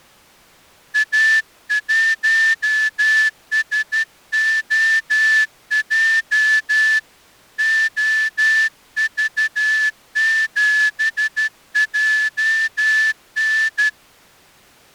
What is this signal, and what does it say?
Morse code, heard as a whistle, hand-sent with a straight key, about 12 wpm. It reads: A1SOJ OV7JN